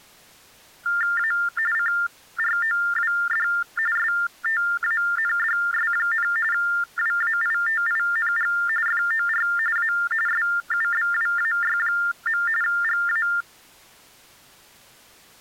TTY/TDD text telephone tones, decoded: A CROWD STANDS, WAITING FOR A SUBWAY. GA

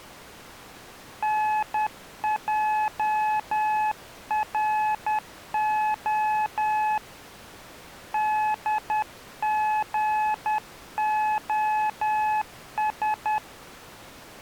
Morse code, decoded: NJRO DGOS

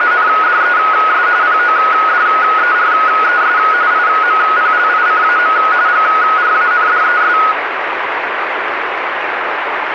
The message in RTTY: … PODERES IMPLICAM GRANDES

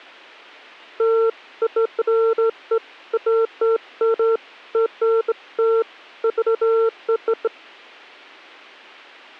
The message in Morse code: none

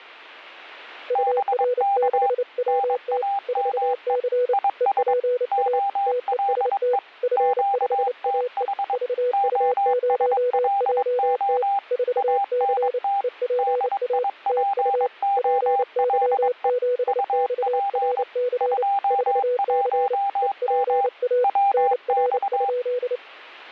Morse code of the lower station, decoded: UR6WT 4C EPA TEST F5AE VU0JT 4C EPA TU PY7XRC 4C EPA NR?

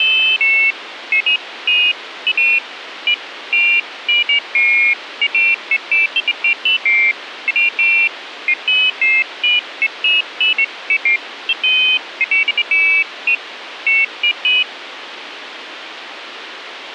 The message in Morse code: none

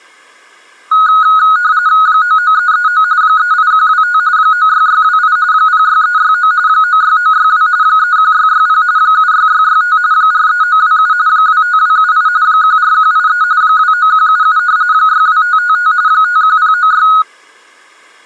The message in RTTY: 99339 38125 96628 06369 96962 31660 76665 43927 25278 14183 29177 62555 51096

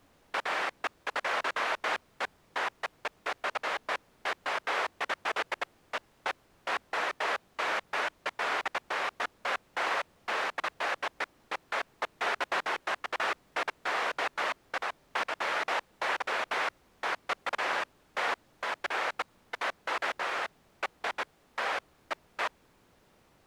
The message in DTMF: none

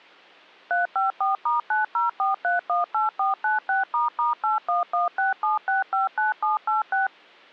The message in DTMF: 354*904318496**81167659786

